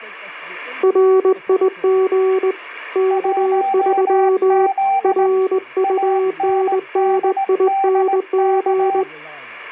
Morse code, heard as two keyed tones, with speech in English. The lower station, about 20 wpm, 380 Hz: RIG K3 RUNNING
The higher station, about 18 wpm, 780 Hz: 1Z ANDDK